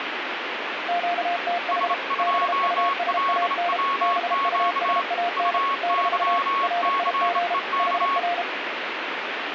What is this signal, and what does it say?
Morse code, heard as two keyed tones, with radio static. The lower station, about 33 wpm, 700 Hz: QTH BUSAN BUSAN - RIG HR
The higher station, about 27 wpm, 1100 Hz: S2LWQ UYCEK